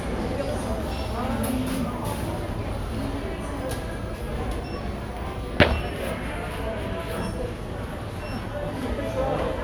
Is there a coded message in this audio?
No, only the noise of a crowd indoors.